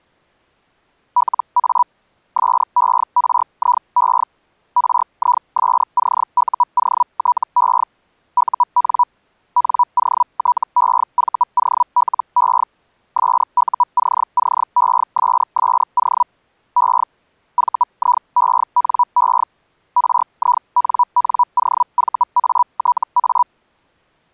Hellschreiber (Feld-Hell, 122.5 baud), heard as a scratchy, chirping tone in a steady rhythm, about 980 Hz. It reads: LA SERIE RISCUOTE UN NOTEVOLE SUCCESSO E VIENE RINNOVATA